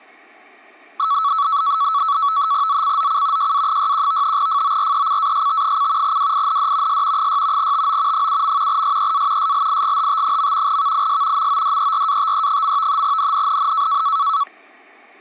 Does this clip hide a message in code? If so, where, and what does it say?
Yes: NAVTEX (SITOR-B), 100 baud, 170 Hz shift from 1.0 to 14.4 s, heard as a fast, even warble, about 1220 Hz centre, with static crashes. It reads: ZCZC JA61 FORECAST: WIND S 6 TO 7. SEA SLIGHT. VIS MODERATE. NNNN